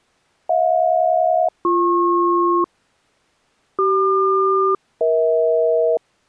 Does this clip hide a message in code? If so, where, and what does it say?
Yes: aircraft SELCAL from 0.5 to 6.0 s, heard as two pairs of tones. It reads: HJ-BP CQ-EH